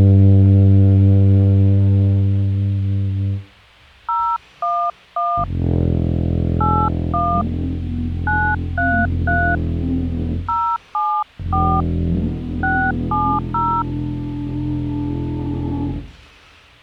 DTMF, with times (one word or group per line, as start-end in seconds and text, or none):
4.1-5.4 011
6.6-7.4 81
8.3-9.6 933
10.5-11.8 074
12.6-13.8 670